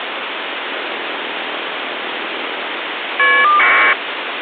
Caller ID data burst, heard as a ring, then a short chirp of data, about 1200 baud, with phone line noise.